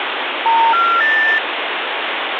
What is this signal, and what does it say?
Telephone call progress tone (North American plan), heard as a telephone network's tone, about 910, 1370, 1800 Hz, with phone line noise. Special information tone.